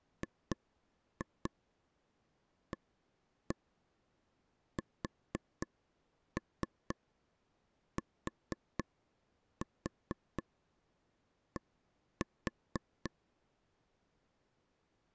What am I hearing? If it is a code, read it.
Tap code, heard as taps on a table, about 4 knocks a second. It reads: GASTD